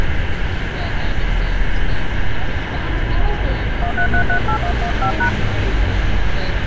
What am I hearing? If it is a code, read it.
DTMF, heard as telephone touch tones, dialled by hand, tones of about 90 ms, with phone line noise and street noise. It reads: 13338115#